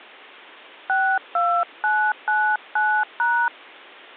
DTMF, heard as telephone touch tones, dialled by hand, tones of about 280 ms. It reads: 62999#